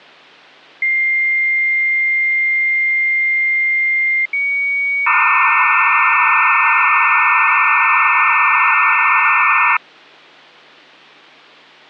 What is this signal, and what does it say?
Dial-up modem handshake (low-speed, two carriers), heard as two whistles, then hiss.